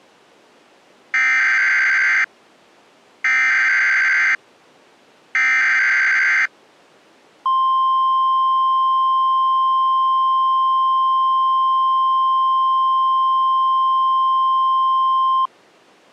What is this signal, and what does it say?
Emergency Alert System (SAME) tones (header bursts, then the 1050 Hz attention tone), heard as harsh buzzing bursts, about 520.83 baud.